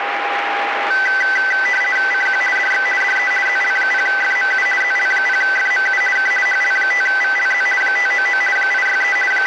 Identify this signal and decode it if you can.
RTTY (50 baud, 450 Hz shift), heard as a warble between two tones, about 1750 Hz centre, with radio static and a steady whistle near 810 Hz. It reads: CQ DX DE ZL0FMU ZL0FMU K HL5VLZ 599 863 …